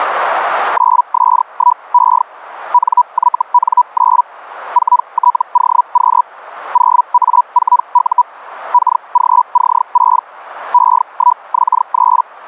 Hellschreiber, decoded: 9S1E NYN9 4TOQ 0A4U KGC6 E1X3

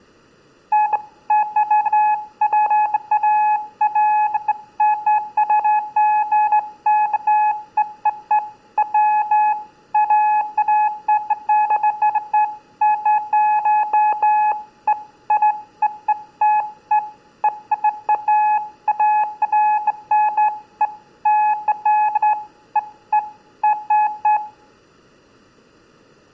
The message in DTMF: none

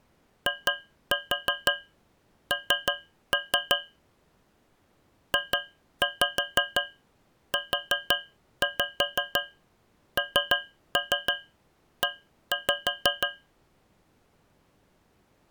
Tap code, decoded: IN JUNE

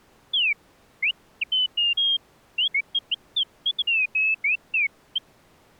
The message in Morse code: none

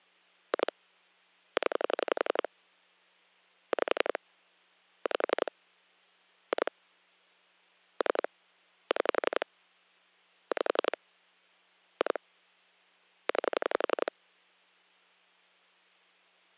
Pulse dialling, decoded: 2 0 5 5 2 3 6 5 2 9

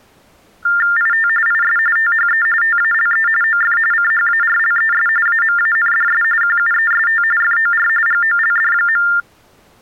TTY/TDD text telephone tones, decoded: IT IS THE TALE OF CHARLES AMANDS QUEST FOR GOLD.

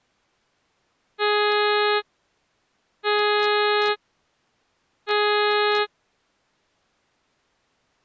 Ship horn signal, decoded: 3 short

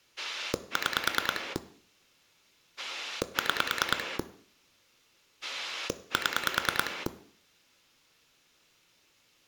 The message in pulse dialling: 6 6 7

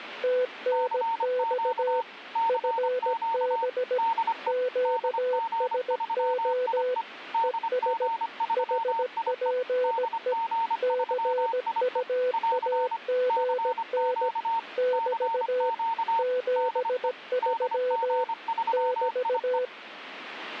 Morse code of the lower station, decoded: TNX FB QSO ES HPE CUAGN <BT> 73 <BT>

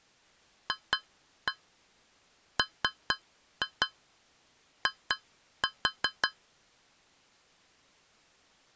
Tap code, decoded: FMI

